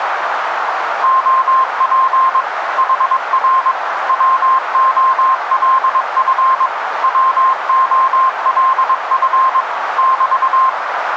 Morse code, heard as a keyed tone, machine-sent, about 22 wpm, 1050 Hz, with radio static and a narrow filter. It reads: OP HR WOLF WOLF <BT>